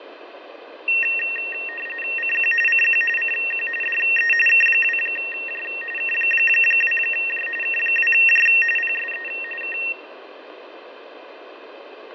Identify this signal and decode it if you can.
RTTY (45.45 baud, 850 Hz shift), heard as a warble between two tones, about 2300 Hz centre, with radio static and fading. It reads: CQ CQ CQ DE K2J K2J K2J PSE K